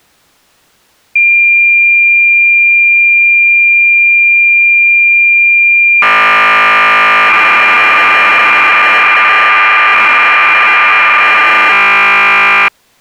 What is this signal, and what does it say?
Cassette data (Kansas City type), 1200 baud, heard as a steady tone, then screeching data.